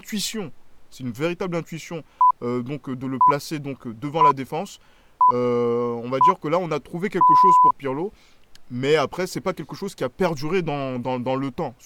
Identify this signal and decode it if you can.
Radio time signal (six pips, as the Greenwich Time Signal), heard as pips, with speech in French.